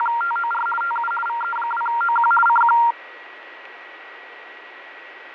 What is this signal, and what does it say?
RTTY (50 baud, 450 Hz shift), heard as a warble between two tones, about 1160 Hz centre, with radio static, fading and a steady whistle near 1920 Hz. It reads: … TU VE2OQ CQ